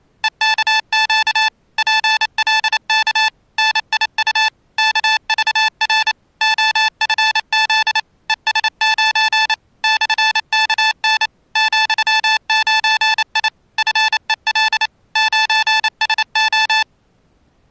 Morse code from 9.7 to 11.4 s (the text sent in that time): /KN